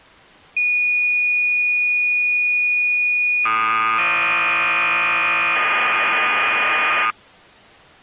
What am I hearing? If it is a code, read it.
Cassette data (Kansas City type), 1200 baud, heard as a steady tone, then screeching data.